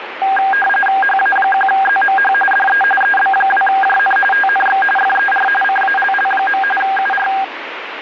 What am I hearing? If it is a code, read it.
RTTY (45.45 baud, 850 Hz shift), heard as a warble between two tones, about 1200 Hz centre, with radio static. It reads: HA1ZMH DE EB2JN TNX FER CALL. UR